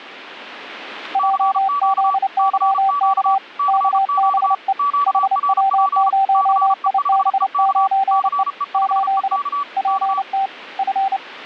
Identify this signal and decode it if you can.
Morse code, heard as two keyed tones. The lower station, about 29 wpm, 780 Hz: JZYK KBE HW0IB9E 8 PT F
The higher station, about 34 wpm, 1150 Hz: CQ CQ CQ QRP CE5EK CE5EK K